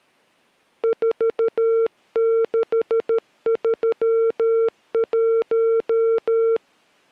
Morse code, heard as a keyed tone, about 13 wpm, 450 Hz. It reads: 4631